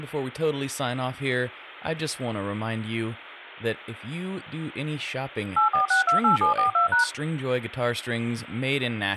DTMF, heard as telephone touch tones, dialled by machine, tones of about 120 ms, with room echo and speech in English. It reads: 84628742#